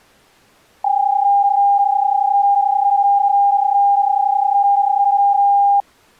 PSK31 (31.25 baud), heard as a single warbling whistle, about 800 Hz.